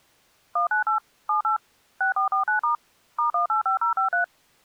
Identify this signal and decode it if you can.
DTMF, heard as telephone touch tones, dialled by machine, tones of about 120 ms. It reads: 198 78 6449* *185053